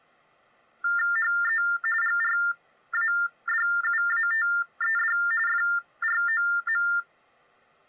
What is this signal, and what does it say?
TTY/TDD text telephone tones (45.45 baud Baudot), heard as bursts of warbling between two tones, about 400 Hz shift, 1600 Hz centre. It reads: HE GRADUATED FROM